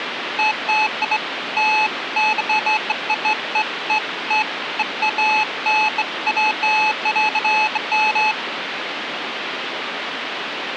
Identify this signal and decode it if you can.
Beeps of irregular length, with phone line noise. There is no code.